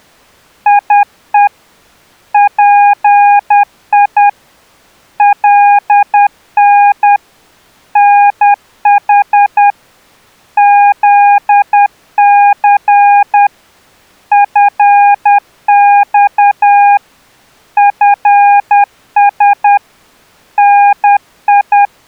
Morse code, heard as a keyed tone, hand-sent with a paddle, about 10 wpm, 810 Hz. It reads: IE PI LN NH ZC FX FS NI